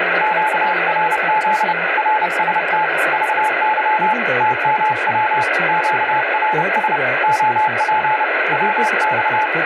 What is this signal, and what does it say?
Morse code, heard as a keyed tone, hand-sent with a paddle, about 30 wpm, 860 Hz, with radio static and speech in English. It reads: QRZ RST VY TMW QRS OP WX